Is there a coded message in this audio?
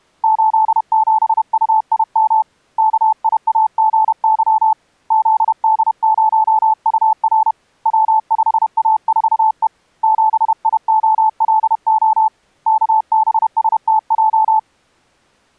Yes: Morse code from 0.2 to 14.7 s, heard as a keyed tone, hand-sent with a paddle, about 31 wpm, 870 Hz. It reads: 87UIM KIAGY ZD0UR W5A4E 7IOLO KBSTJ